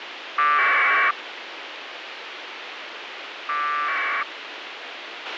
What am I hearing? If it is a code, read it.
Packet radio (AX.25, as in APRS), 1200 baud, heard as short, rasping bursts, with radio hiss and a squelch burst at the end.